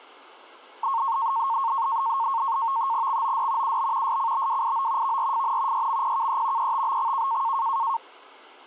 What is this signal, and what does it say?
NAVTEX (SITOR-B), 100 baud, 170 Hz shift, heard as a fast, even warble, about 1000 Hz centre. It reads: XOD UB SCBWIO VRFN YMPKE ETBXK